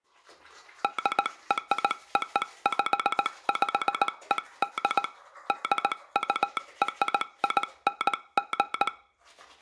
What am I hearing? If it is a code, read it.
Morse code (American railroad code), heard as a telegraph sounder, hand-sent with a straight key, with the noise of a restroom. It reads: DROPPED DURING